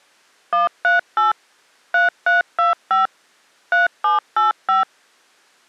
DTMF, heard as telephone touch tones, dialled by machine, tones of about 150 ms. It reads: 138 3325 3785